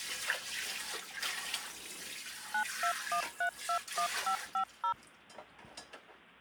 DTMF, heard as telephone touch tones, dialled by machine, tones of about 90 ms, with kitchen noise. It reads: 921321550